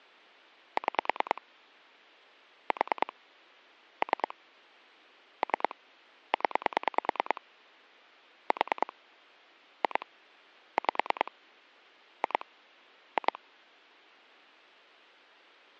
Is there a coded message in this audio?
Yes: pulse dialling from 0.8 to 13.4 s, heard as clicks on a phone line, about 9 pulses a second. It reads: 6 4 3 3 0 4 2 5 2 2